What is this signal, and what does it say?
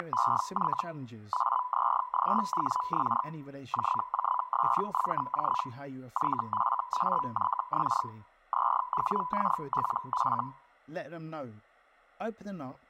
Hellschreiber (Feld-Hell, 122.5 baud), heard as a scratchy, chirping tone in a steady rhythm, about 1000 Hz, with speech in English. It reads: … AZGWX JJSVJ YFAYX ZWKLF